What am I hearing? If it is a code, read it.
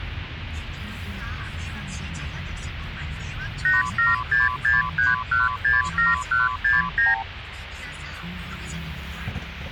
Multi-frequency trunk signalling (R2, with the far end's replies), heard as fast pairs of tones, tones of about 170 ms, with phone line noise and the noise inside a car. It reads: 87663167169